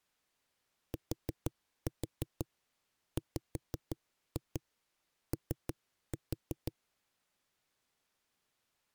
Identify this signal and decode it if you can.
Tap code, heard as knocks on a wall, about 6 knocks a second. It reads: TWO